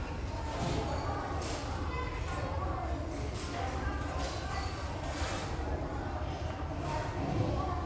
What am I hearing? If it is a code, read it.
The noise of a restaurant. There is no code.